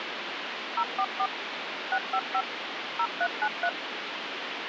DTMF, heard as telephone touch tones, dialled by machine, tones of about 60 ms, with phone line noise. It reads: 044 655 0393